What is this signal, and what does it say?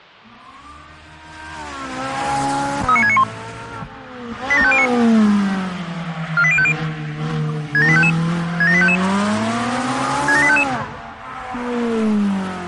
Five-tone selective call (ZVEI), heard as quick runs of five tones, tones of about 70 ms. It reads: 39691 87509 48050 67855 67855 67855